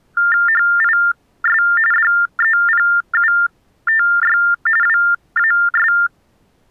TTY/TDD text telephone tones (45.45 baud Baudot), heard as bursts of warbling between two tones, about 400 Hz shift, 1600 Hz centre. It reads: HIS DEPUTY WAS